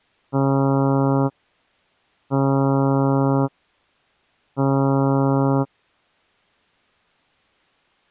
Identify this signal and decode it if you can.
Ship horn signal, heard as a ship's horn, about 140 Hz. 3 short. At sea: I am operating astern propulsion.